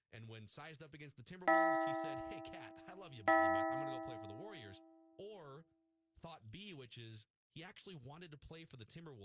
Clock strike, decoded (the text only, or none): 2